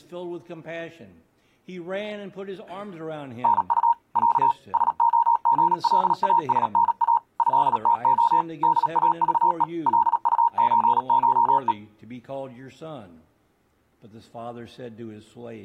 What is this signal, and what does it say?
Morse code (Russian alphabet), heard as a keyed tone, machine-sent, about 37 wpm, 940 Hz. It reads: НУ Я СОГЛАСНА ЭТО ДАЖЕ ЛУЧШЕ